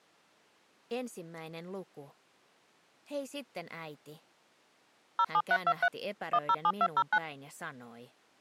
DTMF, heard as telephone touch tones, dialled by machine, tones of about 60 ms. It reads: 07323 107209